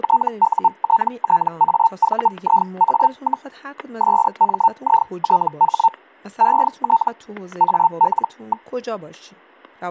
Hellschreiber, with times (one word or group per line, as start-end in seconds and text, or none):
0.0-3.5 TUTTAVIA,
4.0-5.9 SMITH
6.4-7.1 ET
7.6-8.7 AL.